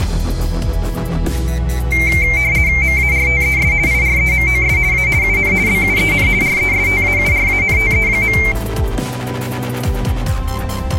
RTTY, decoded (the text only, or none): MARTES IREMOS A UN BUEN RESTAURANTE.